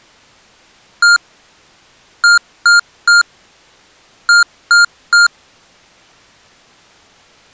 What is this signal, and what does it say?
Beep code, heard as beeps from a small speaker, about 1400 Hz. 1-3-3. In Phoenix BIOS tables: chip or data line failure in the first 64 KB of memory.